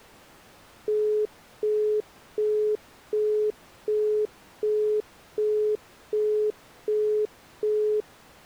Telephone call progress tone (as in the UK, Australia and similar networks), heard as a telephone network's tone, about 420 Hz, 0.375 s on and 0.375 s off. Busy tone.